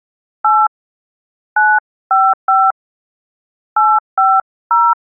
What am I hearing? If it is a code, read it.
DTMF, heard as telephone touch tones, dialled by hand, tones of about 220 ms. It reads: 8 955 850